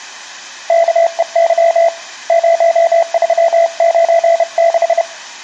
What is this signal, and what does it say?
Morse code, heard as a keyed tone, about 31 wpm, 670 Hz, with room echo. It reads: KEY 0396